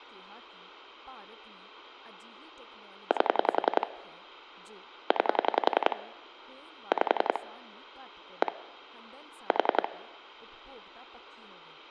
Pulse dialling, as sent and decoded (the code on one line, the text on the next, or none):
8 / 9 / 5 / 1 / 4
8 9 5 1 4